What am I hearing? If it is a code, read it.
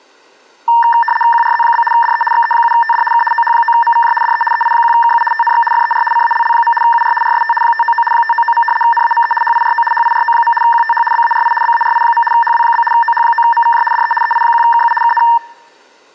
RTTY (75 baud, 850 Hz shift), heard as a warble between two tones, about 1360 Hz centre. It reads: QRZ? DE XE7TD K OH9MVJ DE EI1KU TNX FER CALL. UR RST 599 599. NAME HIRO HIRO. QTH BARI BARI. HW? OH9MVJ DE EI1KU KN